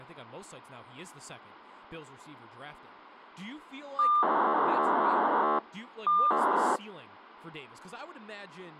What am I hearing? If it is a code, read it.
POCSAG pager data (2400 baud), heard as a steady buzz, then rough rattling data, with radio hiss and speech in English.